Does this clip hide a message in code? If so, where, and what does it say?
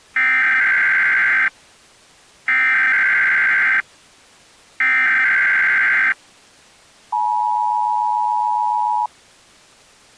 Yes: Emergency Alert System (SAME) tones (header bursts, then the 853 and 960 Hz attention tone) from 0.2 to 9.1 s, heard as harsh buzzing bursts, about 520.83 baud.